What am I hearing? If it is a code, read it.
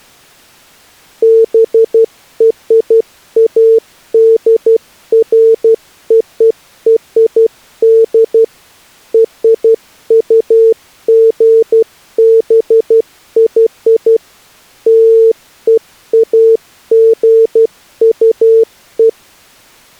Morse code (American railroad code), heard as a keyed tone, machine-sent, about 450 Hz. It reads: BRADFORD RUGBY LEAGUE